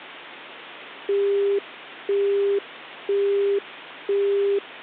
Telephone call progress tone (single-tone plan, as in Europe, Japan and elsewhere), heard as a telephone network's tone, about 400 Hz, 0.5 s on and 0.5 s off, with hum. Busy tone.